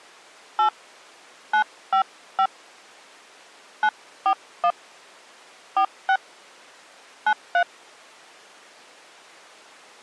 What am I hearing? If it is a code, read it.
DTMF, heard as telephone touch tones, dialled by hand, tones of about 80 ms. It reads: 8 955 941 46 93